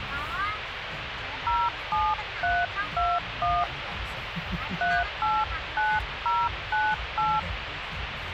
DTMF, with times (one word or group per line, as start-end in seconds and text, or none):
1.5-3.6 07321
4.8-7.4 389098